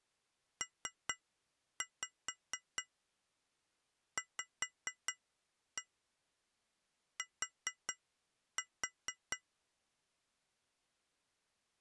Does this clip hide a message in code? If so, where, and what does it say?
Yes: tap code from 0.6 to 9.4 s, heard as taps on glass, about 4 knocks a second. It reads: PVT